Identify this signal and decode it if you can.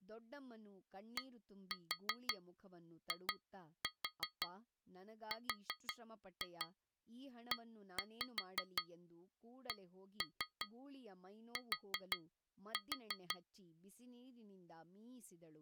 Tap code, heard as taps on glass, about 5 knocks a second, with speech in Kannada. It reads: DIRECT